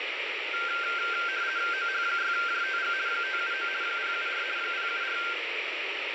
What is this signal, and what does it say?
RTTY (50 baud, 170 Hz shift), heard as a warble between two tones, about 1470 Hz centre, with radio static. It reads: OH6JTG 579 074 074